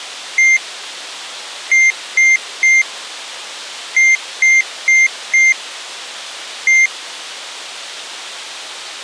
Beep code, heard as a piezo beeper, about 2100 Hz. 1-3-4-1. In Phoenix BIOS tables: memory failure on an address line.